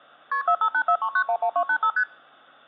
Multi-frequency trunk signalling (R1, as on North American trunks), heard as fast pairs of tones, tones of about 70 ms. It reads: KP 45843911285 ST